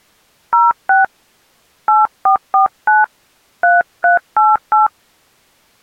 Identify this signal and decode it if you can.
DTMF, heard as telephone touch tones, dialled by hand, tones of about 140 ms. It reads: 06 8449 3388